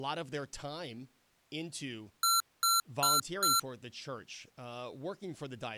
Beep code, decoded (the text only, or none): 4 short